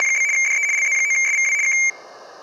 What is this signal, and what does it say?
RTTY (75 baud, 170 Hz shift), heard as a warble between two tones, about 2200 Hz centre. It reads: … DE LZ9SVW K